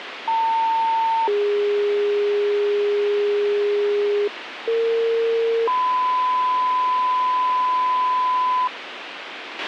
Two-tone page, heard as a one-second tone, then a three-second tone, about 900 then 410 Hz, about 460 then 1010 Hz, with radio hiss and a squelch burst at the end.